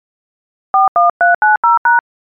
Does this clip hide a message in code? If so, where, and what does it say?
Yes: DTMF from 0.7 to 2.0 s, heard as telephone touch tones, dialled by hand, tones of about 140 ms. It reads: 41390#